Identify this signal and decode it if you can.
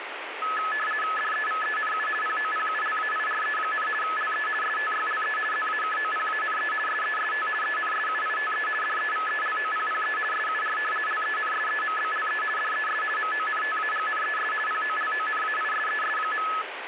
RTTY (50 baud, 450 Hz shift), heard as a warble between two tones, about 1500 Hz centre, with radio static. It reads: DEVENU POPULAIRE, LE STYLE ZAKOPANE SEST ENSUITE DEVELOPPE SUR LENSEMBLE DES MONTAGNES POLONAISES.